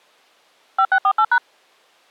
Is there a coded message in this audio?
Yes: DTMF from 0.8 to 1.4 s, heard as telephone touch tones, dialled by machine, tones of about 70 ms. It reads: 5648#